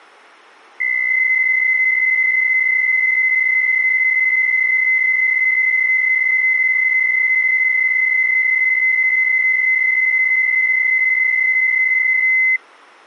PSK63 (62.5 baud), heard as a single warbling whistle, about 2050 Hz.